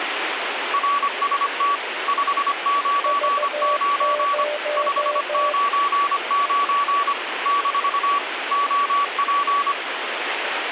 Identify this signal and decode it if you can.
Morse code, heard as two keyed tones, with radio static. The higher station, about 25 wpm, 1140 Hz: RST 599 599 - OP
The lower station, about 15 wpm, 600 Hz: V0